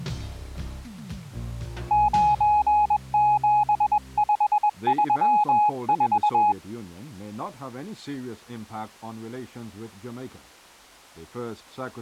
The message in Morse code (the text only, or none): 97534